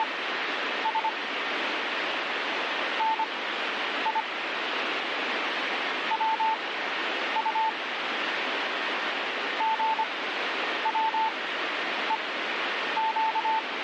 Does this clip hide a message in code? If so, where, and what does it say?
Yes: Morse code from 0.0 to 13.7 s, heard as a keyed tone, machine-sent, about 25 wpm, spaced as for 9 wpm, 880 Hz, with radio static. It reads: … NI WU GWEQ